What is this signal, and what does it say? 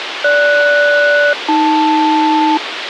Aircraft SELCAL, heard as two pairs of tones, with radio hiss. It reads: GS-AL